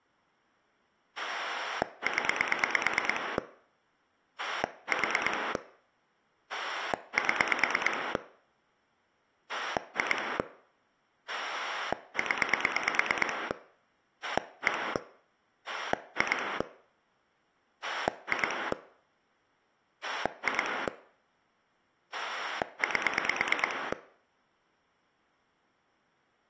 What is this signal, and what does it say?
Pulse dialling, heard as a rotary dial, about 9 pulses a second. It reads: 0 4 7 2 0 1 2 2 2 8